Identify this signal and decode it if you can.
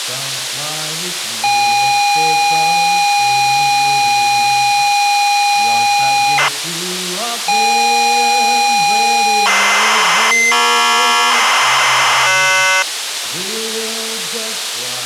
ZX Spectrum tape loading, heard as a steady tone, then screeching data, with tape hiss.